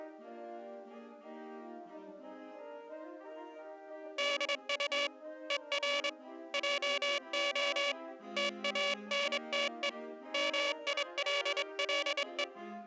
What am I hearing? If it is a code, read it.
Morse code, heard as a buzzer, hand-sent with a straight key, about 24 wpm. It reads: DU ER JO TANTE MILLE